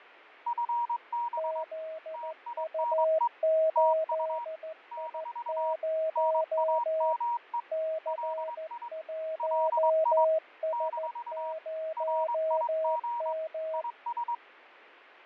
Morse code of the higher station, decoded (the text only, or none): FB TINE TU - NAME LI LI - RIG IS